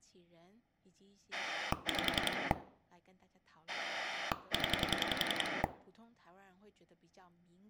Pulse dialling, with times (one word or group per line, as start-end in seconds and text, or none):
1.3-2.5 5
3.7-5.6 0